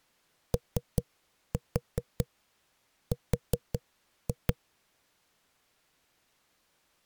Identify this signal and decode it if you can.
Tap code, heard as knocks on a wall, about 5 knocks a second. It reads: OR